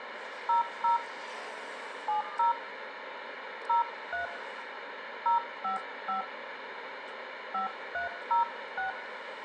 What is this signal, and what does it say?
DTMF, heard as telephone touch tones, dialled by hand, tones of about 130 ms, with radio hiss, room echo and street noise. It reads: 00 70 03 055 5306